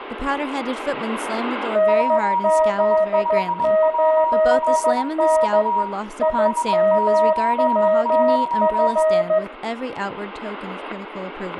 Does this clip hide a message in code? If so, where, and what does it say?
Yes: Morse code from 1.7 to 9.4 s, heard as two keyed tones, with static crashes, room echo and speech in English. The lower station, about 14 wpm, 630 Hz: NZ8N IMWF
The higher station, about 21 wpm, 950 Hz: JI5WLX 599